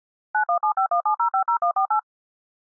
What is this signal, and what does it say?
DTMF, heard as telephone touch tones, dialled by machine, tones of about 90 ms. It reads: 917517050148